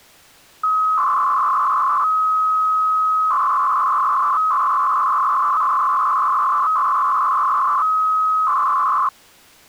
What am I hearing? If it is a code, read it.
300-baud modem data (Bell 103 tones), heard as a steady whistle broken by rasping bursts, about 300 baud, 200 Hz shift.